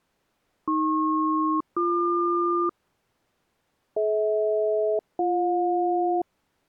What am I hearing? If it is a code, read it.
Aircraft SELCAL, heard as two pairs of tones. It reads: AP-BQ DH-BJ